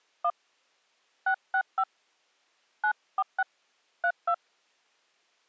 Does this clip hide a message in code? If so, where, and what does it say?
Yes: DTMF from 0.2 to 4.3 s, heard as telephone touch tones, dialled by hand, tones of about 70 ms. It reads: 1 665 946 32